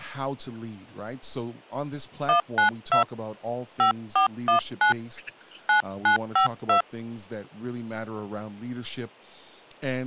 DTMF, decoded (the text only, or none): 192 5419 9952